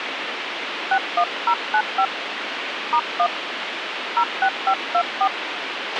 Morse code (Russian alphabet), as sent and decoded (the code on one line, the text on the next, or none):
none